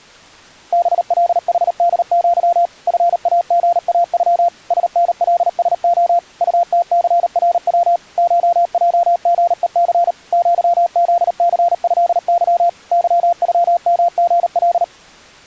Morse code (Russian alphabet), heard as a keyed tone, machine-sent, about 38 wpm, 690 Hz. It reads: БЛХДЪ ФАГАЮ СНЛСО УТЦРВ ШЙГЕЦ ЪЗЦЭЫ ЫЮМГЛ